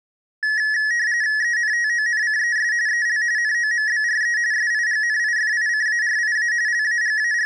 RTTY (45.45 baud, 170 Hz shift), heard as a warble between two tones, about 1800 Hz centre. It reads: ENTONCES EL NOMBRE SIGNIFICARIA …